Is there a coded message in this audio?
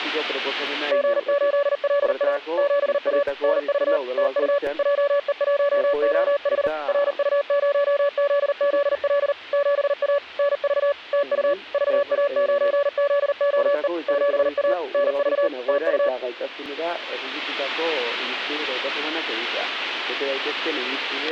Yes: Morse code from 0.9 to 16.1 s, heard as a keyed tone, machine-sent, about 39 wpm, 570 Hz. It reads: G8LA 7A NV TU JE1OH RU0ZZL 7A NV TU VA9ZOE 7A NV TU